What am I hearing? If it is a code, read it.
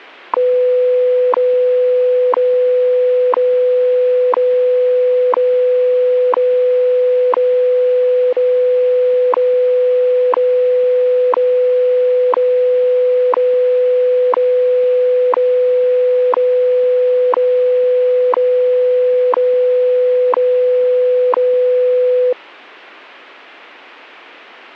Radio time signal (WWV, Colorado), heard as ticks, one a second.